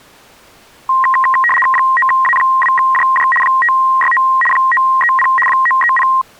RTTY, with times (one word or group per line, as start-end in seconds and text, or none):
1.7-3.3 9A2JJ
3.4-4.2 569
4.5-5.3 930
5.5-6.1 930